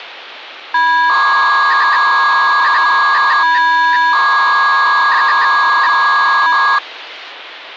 300-baud modem data (V.21 tones), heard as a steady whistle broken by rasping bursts, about 300 baud, 200 Hz shift.